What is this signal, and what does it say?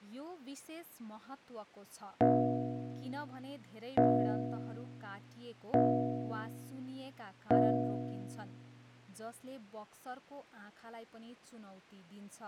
Clock strike, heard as a bell, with speech in Nepali. 4. Four o'clock.